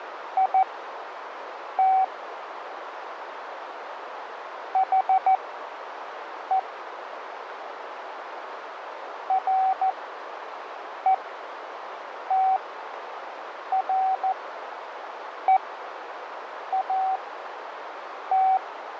Morse code, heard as a keyed tone, machine-sent, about 14 wpm, spaced as for 6 wpm, 760 Hz, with radio static, fading and a narrow filter. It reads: IT HE RETREAT